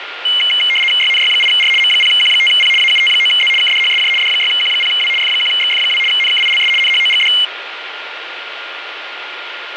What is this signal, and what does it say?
RTTY (75 baud, 850 Hz shift), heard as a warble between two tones, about 2550 Hz centre, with radio static and a steady whistle near 1410 Hz. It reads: YNY8R M0Q5P AUT9Z KDHSJ D6Q0W F1XF2 NKILS NHOGD